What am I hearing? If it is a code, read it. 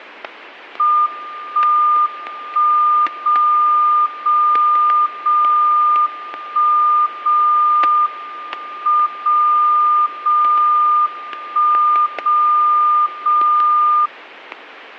Radio time signal (WWVB), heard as a tone whose level steps once a second, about 1210 Hz, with static crashes. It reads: 1 1 0 0 0 1 0 M 0 0 1 0 0